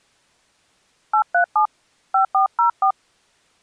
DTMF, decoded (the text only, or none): 837 5404